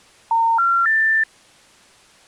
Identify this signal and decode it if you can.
Telephone call progress tone (North American plan), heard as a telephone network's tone, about 910, 1370, 1800 Hz. Special information tone.